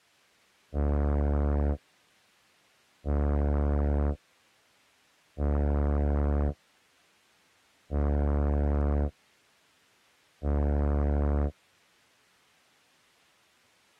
Ship horn signal, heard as a ship's horn, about 70 Hz. 5 short. At sea: I doubt that you are doing enough to avoid a collision.